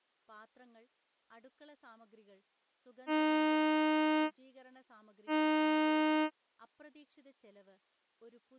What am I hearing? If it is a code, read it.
Ship horn signal, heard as a ship's horn, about 310 Hz, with speech in Malayalam. 2 short. At sea: I am altering course to port.